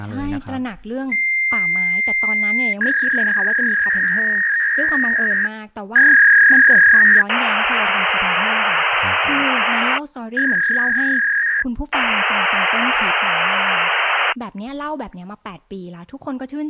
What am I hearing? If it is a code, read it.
Fax machine handshake, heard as a long tone, a warble and hiss, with speech in Thai.